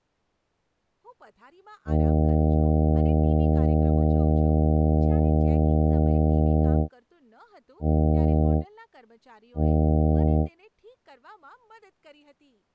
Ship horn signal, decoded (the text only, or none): 1 long, 2 short